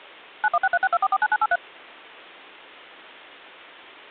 DTMF, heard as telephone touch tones, dialled by machine, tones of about 50 ms. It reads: 916362449983